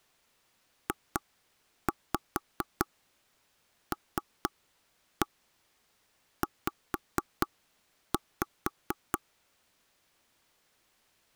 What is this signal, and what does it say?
Tap code, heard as knocks on wood, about 4 knocks a second. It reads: JLZ